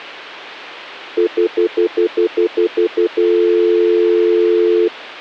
Telephone call progress tone (North American plan), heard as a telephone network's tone, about 350, 440 Hz, 0.1 s on and 0.1 s off, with hum. Stutter dial tone.